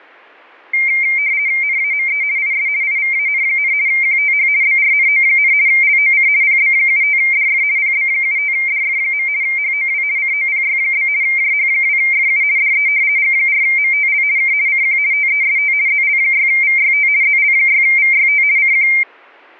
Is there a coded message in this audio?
Yes: RTTY (50 baud, 170 Hz shift) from 0.7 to 19.0 s, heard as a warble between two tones, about 2200 Hz centre. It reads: NAME IS IVAN, QTH BRNO, LOC PB75DF PB75DF. HOW COPY? JH2FU DE G4MTL K CQ TEST ZL6VYT ZL6VYT CQ